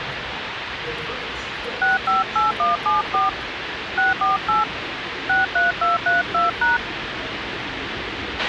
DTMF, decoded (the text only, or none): 658174 648 63232#